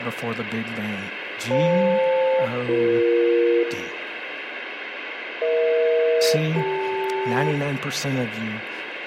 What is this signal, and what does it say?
Aircraft SELCAL, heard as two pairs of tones, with radio static, room echo and speech in English. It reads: FL-BE EH-CL